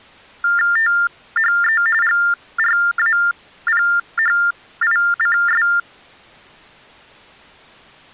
TTY/TDD text telephone tones (45.45 baud Baudot), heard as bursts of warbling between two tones, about 400 Hz shift, 1600 Hz centre. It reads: THE GRAPHICS